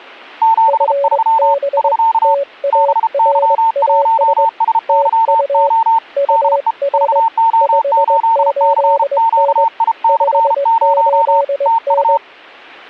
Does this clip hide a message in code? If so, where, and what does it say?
Yes: Morse code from 0.4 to 12.2 s, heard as two keyed tones. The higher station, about 33 wpm, 900 Hz: 73 <SK> BY1SYO DE VO8CQI/0 TU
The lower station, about 21 wpm, 560 Hz: FB TARAS TU UR 58N 58N